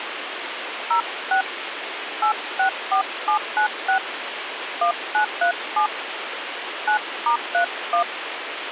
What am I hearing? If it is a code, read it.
DTMF, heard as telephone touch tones, dialled by hand, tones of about 100 ms, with phone line noise. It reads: 06 864796 1937 9*31